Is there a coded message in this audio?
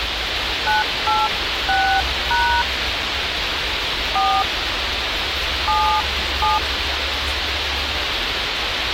Yes: DTMF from 0.7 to 6.6 s, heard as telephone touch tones, dialled by hand, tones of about 280 ms, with radio hiss, a squelch burst at the end and the noise of a park. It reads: 986# 4 77